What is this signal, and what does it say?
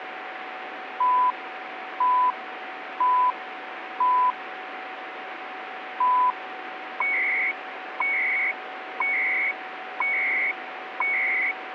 Radio time signal (CHU, Canada), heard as beeps and data bursts, one a second, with radio static and a steady whistle near 750 Hz.